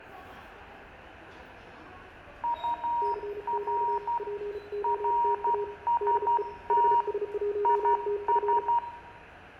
Morse code, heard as two keyed tones, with room echo and the noise of a subway station. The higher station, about 12 wpm, 950 Hz: UR RST IS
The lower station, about 34 wpm, 410 Hz: CQ POTA DE HS1TF